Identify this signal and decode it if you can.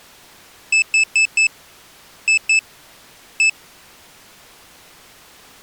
Beep code, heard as a piezo beeper, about 2600 Hz. 4-2-1. In Phoenix BIOS tables: timer tick failure.